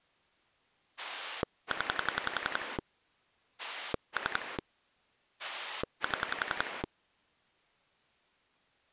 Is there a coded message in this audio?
Yes: pulse dialling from 1.0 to 6.9 s, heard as a rotary dial, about 11 pulses a second. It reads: 0 3 7